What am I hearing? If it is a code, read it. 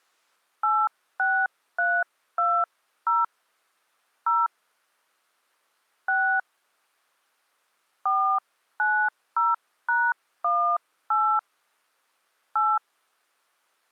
DTMF, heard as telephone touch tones, dialled by hand, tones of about 270 ms. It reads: 86320 0 6 490#18 8